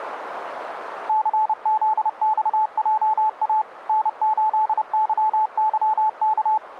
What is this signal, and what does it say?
Morse code, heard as a keyed tone, machine-sent, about 30 wpm, 870 Hz, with radio static. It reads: CZXJA N8YYK